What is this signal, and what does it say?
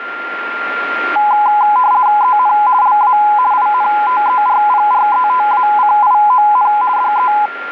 RTTY (50 baud, 170 Hz shift), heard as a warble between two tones, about 920 Hz centre, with radio static and a steady whistle near 1390 Hz. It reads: EN LA INTERPRETACION DE